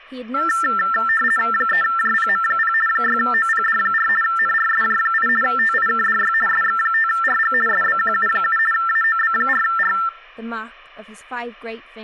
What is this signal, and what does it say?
RTTY (50 baud, 450 Hz shift), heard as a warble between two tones, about 1550 Hz centre, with speech in English. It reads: 3JPM0 6OPD4 NRSJ8 TIKDY SX5RG SBQU7 AOB4R